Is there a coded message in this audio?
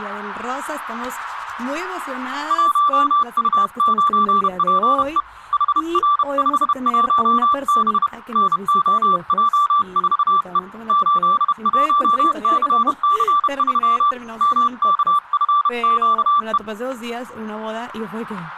Yes: Morse code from 2.4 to 16.6 s, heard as a keyed tone, hand-sent with a bug key, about 31 wpm, 1170 Hz, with static crashes and speech in Spanish. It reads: 1U9PE HR51B NOJ4E 81CC3 MKFQE